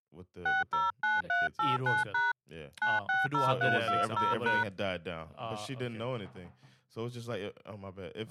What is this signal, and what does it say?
DTMF, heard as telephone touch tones, dialled by hand, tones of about 180 ms, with speech in English. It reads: 609389# 960320#